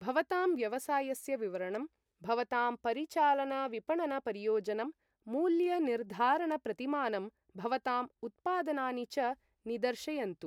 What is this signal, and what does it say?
Speech in Sanskrit. There is no code.